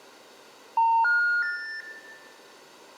Telephone call progress tone (North American plan), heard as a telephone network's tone, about 910, 1430, 1800 Hz, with room echo. Special information tone.